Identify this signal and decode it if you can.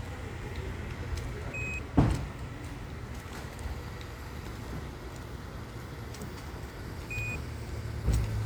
Quindar tones, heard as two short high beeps, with the noise of a residential street.